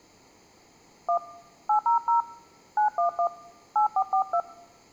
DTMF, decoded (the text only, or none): 1 800 911 8442